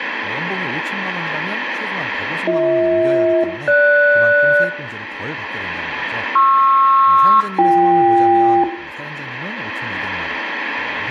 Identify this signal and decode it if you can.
Aircraft SELCAL, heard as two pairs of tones, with room echo and speech in Korean. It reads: BH-GS PR-BK